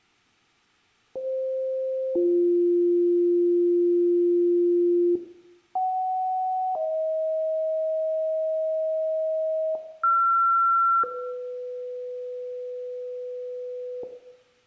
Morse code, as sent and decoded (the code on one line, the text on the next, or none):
none